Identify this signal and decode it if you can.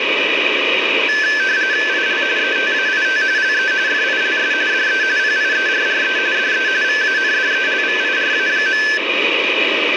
RTTY (45.45 baud, 170 Hz shift), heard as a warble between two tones, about 1650 Hz centre, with radio static. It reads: IL ETAIT LE FILS DE PIERRE DE VANDELVIRA.